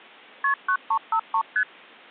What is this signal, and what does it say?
Multi-frequency trunk signalling (R1, as on North American trunks), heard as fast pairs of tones, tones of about 80 ms. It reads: KP 9353 ST